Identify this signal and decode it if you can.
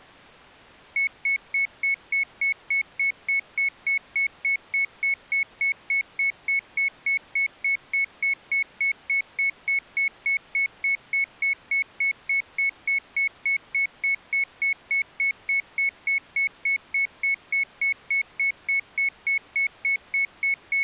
Evenly repeated beeps. There is no code.